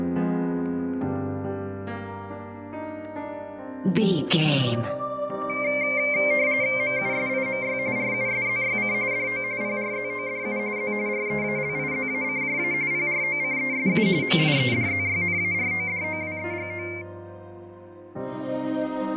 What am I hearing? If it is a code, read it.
RTTY (45.45 baud, 170 Hz shift), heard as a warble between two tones, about 2200 Hz centre, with fading and static crashes. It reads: MUSIMY RUSZYC DO PRZODU Z REALIZACJA PROCESU MIEDZYNARODOWEGO